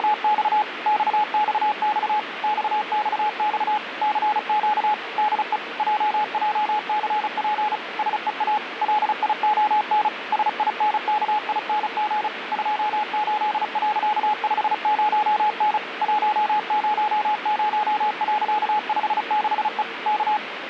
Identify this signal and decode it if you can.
Morse code, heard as a keyed tone, machine-sent, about 35 wpm, 850 Hz, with radio static. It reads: … XXX XXX CQ DE JJCP SEA LION SINKING 28.50N 100.56E K